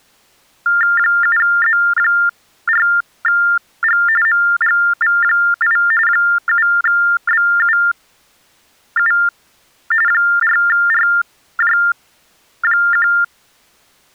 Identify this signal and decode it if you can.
TTY/TDD text telephone tones (45.45 baud Baudot), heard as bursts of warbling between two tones, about 400 Hz shift, 1600 Hz centre. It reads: 7Z4G MGV8 7BUU 4RJ1